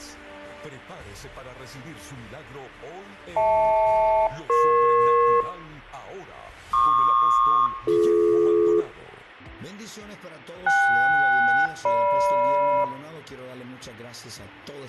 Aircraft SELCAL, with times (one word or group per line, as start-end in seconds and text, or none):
3.4-5.4 HL-EP
6.7-8.8 PQ-BD
10.7-12.8 KS-GM